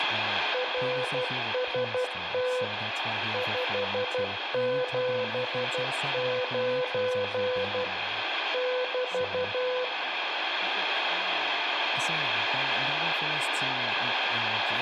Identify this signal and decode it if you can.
Morse code, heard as a keyed tone, machine-sent, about 12 wpm, 500 Hz, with radio static, room echo and speech in English. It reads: RST 579 <BT>